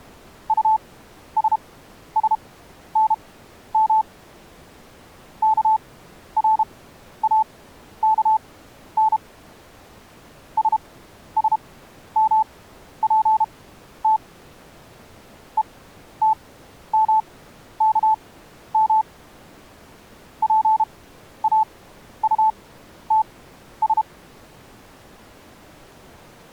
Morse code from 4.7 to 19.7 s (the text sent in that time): KRAKN SSMPT ETMKM